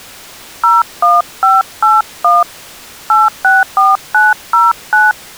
DTMF, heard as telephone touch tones, dialled by hand, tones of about 180 ms. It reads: 01581 864909